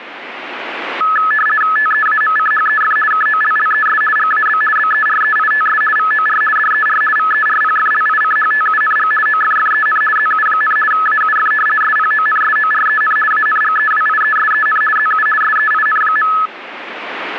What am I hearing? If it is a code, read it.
RTTY (50 baud, 450 Hz shift), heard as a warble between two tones, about 1500 Hz centre. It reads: TEAMCHEF KOLLES GAB BEREITS VOR DER VERPFLICHTUNG OFFEN ZU, AUF SPONSOREN ANGEWIESEN ZU SEIN.